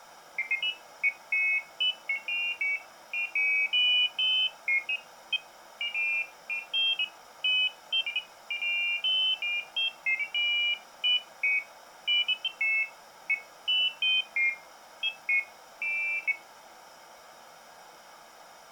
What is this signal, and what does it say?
Pairs of high tones at irregular times. There is no code.